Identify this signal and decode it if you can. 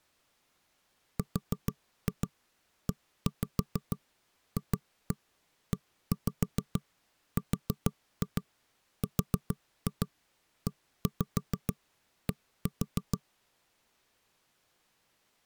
Tap code, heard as knocks on wood, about 6 knocks a second. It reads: REFERRED